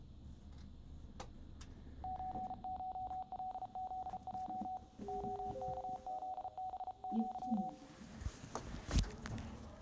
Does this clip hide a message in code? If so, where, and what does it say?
Yes: Morse code (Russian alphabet) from 2.0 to 7.8 s, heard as a keyed tone, hand-sent with a paddle, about 34 wpm, 750 Hz, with room echo and the noise inside a lift. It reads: ЧШЛЗЙ ОКЗБЪ